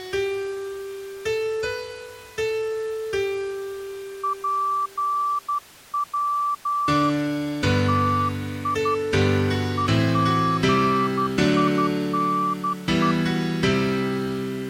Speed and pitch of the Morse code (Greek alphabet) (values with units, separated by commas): 12 wpm, 1160 Hz